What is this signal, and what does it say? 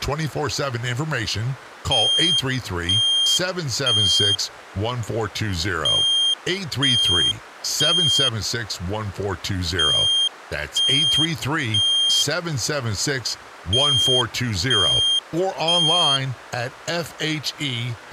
Alarm pattern, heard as an alarm's beeps, played four times, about 3200 Hz, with speech in English. Temporal three. Smoke or fire, evacuate.